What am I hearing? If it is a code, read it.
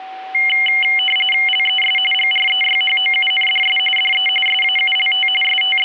RTTY (45.45 baud, 850 Hz shift), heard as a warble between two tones, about 2550 Hz centre, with a steady whistle near 760 Hz. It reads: LES GREYHOUNDS DE SAULT …